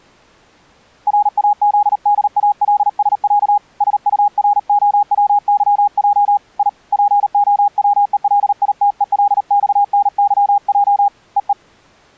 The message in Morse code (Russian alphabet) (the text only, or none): РАЗДАЛСЯ СУРОВЫЙ И ПОВЕЛИТЕЛЬНЫЙ ЕЕ